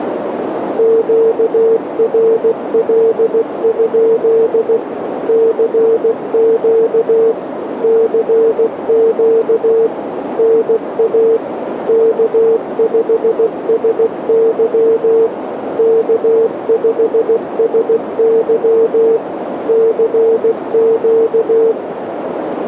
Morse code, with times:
0.8-4.8 QRL?
5.3-7.3 CQ
7.8-9.9 CQ
10.4-11.4 NA
11.9-15.3 K5SY
15.8-19.2 K5SY
19.7-21.7 CQ

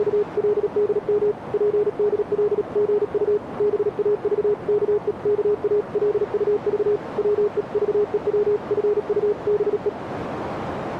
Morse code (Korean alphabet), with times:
0.0-1.3 …
1.5-3.4 즉시
3.6-7.0 돌아오길
7.2-9.9 바랍니다

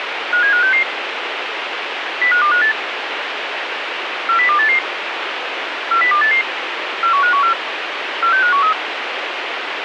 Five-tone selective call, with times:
0.3-0.8 57566
2.2-2.7 05258
4.3-4.8 40288
5.9-6.4 40288
7.0-7.5 41514
8.2-8.7 46513

